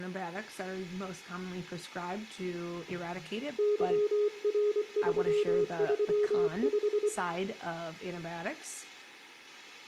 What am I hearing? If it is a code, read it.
Morse code, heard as a keyed tone, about 24 wpm, 420 Hz, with room echo and speech in English. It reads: YR335